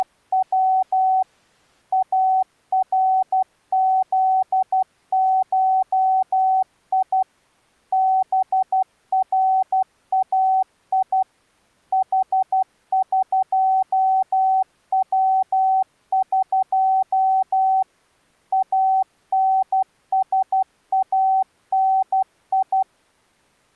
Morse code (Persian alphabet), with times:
0.0-1.2 …
1.9-7.2 ارزشی
7.9-11.2 برای
11.9-17.8 حقوق
18.5-22.8 انسانی

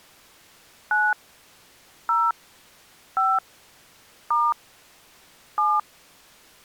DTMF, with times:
0.9-1.1 9
2.1-2.3 0
3.2-3.4 5
4.3-4.5 *
5.6-5.8 7

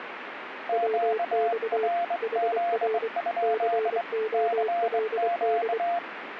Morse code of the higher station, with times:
0.7-4.0 QRZ?
4.3-6.0 CQ

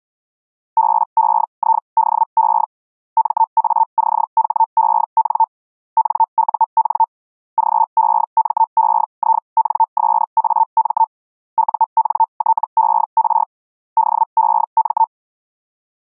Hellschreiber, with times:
0.8-2.6 BEIDE
3.2-5.4 MACHEN
6.0-7.0 NUN
7.6-11.0 GEMEINSAM
11.6-13.4 UNTER
14.0-15.0 DEM

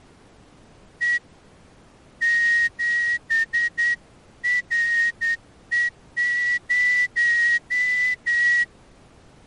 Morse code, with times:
1.0-1.2 E
2.2-8.6 7RE0

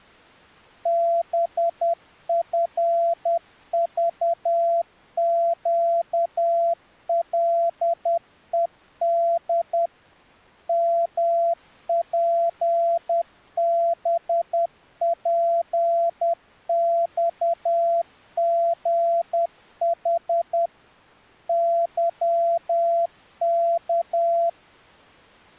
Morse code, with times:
0.9-9.9 BFVQLED
10.7-20.7 MPBPXGH
21.5-24.5 YK

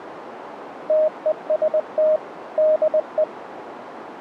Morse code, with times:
0.9-2.2 TEST
2.6-3.2 DE

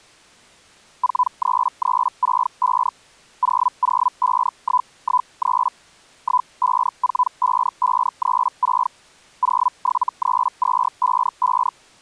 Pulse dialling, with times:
none

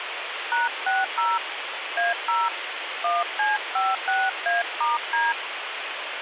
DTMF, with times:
0.5-1.4 #60
2.0-2.5 A0
3.0-5.3 1C56A*D

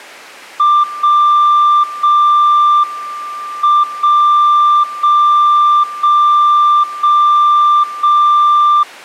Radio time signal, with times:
0.8-1.8 0
1.8-2.8 0
2.8-3.8 M
3.8-4.8 0
4.8-5.8 0
5.8-6.8 0
6.8-7.8 0
7.8-8.8 0

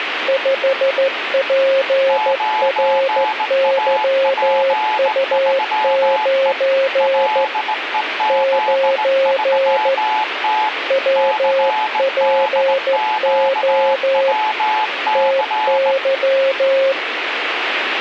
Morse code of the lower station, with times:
0.3-7.4 5PRYU9
8.3-9.9 9
10.9-14.3 WPO
15.2-16.9 TY

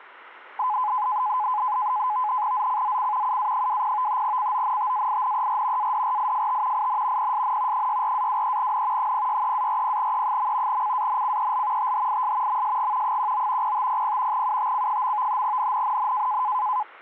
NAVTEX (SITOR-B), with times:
2.5-3.4 ZCZC
3.2-4.2 UA20
4.2-5.9 CONTAINER
5.8-6.9 ADRIFT
6.7-7.3 IN
7.2-7.9 PSN
7.7-9.1 64-23N
9.0-10.8 063-40E.
10.7-11.9 CANCEL
11.8-12.6 THIS
12.5-13.2 MSG
13.0-13.7 19
13.6-14.4 0500
14.3-15.4 UTC.
15.4-16.4 NNNN

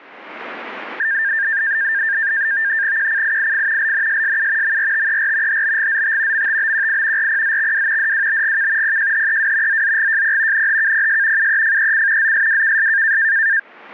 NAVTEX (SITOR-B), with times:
3.0-3.9 QCIIF
3.8-4.8 LNSSU
4.6-5.6 MRTER
5.5-6.5 HBGZT
6.3-7.3 MTBQI
7.2-8.1 RPZXW
8.0-9.0 DWBGK
8.8-9.8 PJHEW
9.7-10.7 ZZGJP
10.5-11.5 NHKPS
11.4-12.3 UEFEC
12.2-13.2 ZSWKS

